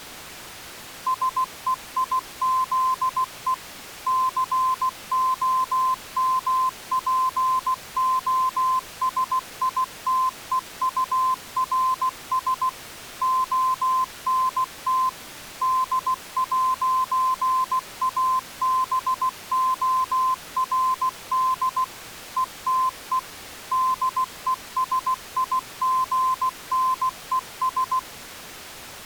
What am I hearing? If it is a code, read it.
Morse code, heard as a keyed tone, machine-sent, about 16 wpm, 1040 Hz. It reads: SEIZE COMPOSITEURS ONT D'ABORD ETE DESIGNES